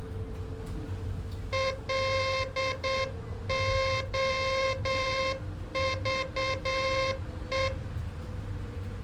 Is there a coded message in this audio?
Yes: Morse code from 1.5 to 7.7 s, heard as a buzzer, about 8 wpm, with room echo and the noise inside a bus. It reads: LOVE